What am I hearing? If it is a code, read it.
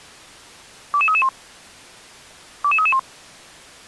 Five-tone selective call (ZVEI), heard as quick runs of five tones, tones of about 70 ms. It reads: 22331 22331